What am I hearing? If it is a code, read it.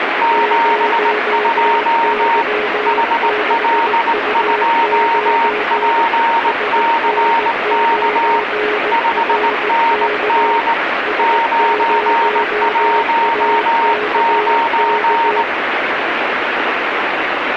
Morse code, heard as two keyed tones, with radio static. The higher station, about 19 wpm, 920 Hz: 72 HL2PCK 5NN 919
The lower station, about 18 wpm, 420 Hz: 0Y6U9 SN9RK S0AKK